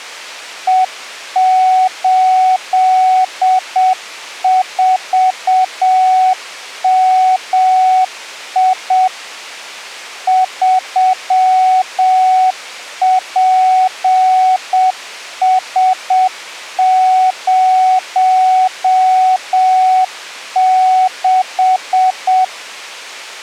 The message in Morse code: E84MI 3PS06

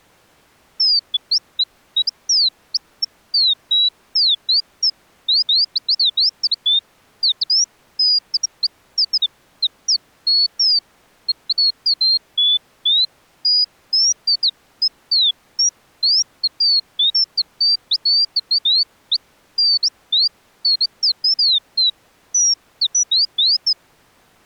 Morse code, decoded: none

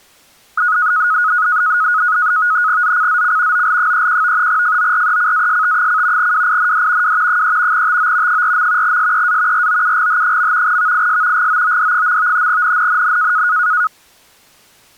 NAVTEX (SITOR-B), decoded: ZCZC OL31 FORECAST: WIND W 3 TO 4. SEA ROUGH. VIS GOOD. NNNN

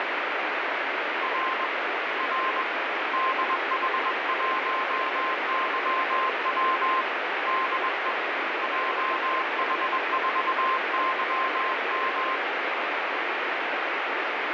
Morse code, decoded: R R DH1YW DE JH4YM

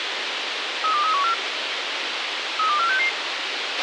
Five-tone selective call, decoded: 32314 32466

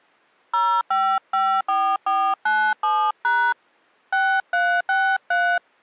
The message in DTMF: 0554497# 6363

